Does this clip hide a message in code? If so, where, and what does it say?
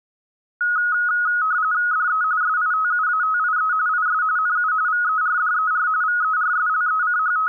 Yes: RTTY (45.45 baud, 170 Hz shift) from 0.6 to 7.5 s, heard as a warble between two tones, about 1360 Hz centre. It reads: DE SITUATIE IS NU VERDER …